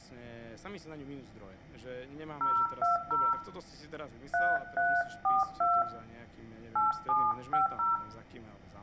DTMF, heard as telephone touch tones, dialled by hand, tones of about 180 ms, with room echo and speech in Slovak. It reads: 020 3342 8750